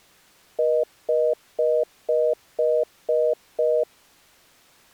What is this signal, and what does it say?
Telephone call progress tone (North American plan), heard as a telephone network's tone, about 480, 620 Hz, 0.25 s on and 0.25 s off. Congestion tone.